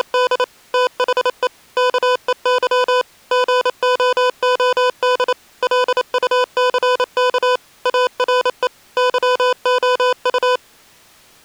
Morse code, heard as electronic beeps, machine-sent, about 28 wpm, 500 Hz. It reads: … THE KEY GOOD LUCK ARE YOU